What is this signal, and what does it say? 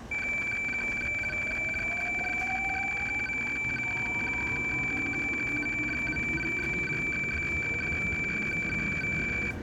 Weather fax (radiofax), 120 lines a minute, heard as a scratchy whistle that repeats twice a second, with room echo and the noise of a subway station.